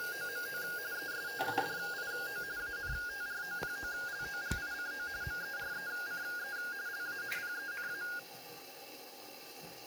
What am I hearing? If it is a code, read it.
RTTY (45.45 baud, 170 Hz shift), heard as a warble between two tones, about 1550 Hz centre, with room echo and the noise of a restroom. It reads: … ESTUDIO ANTROPOLOGICO MERECE LA PENA